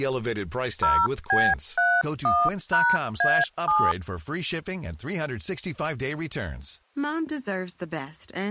DTMF, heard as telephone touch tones, dialled by machine, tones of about 240 ms, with speech in English. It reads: 0B31#A7